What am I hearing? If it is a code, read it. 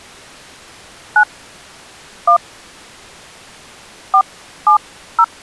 DTMF, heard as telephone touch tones, dialled by hand, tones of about 90 ms. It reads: 9 1 470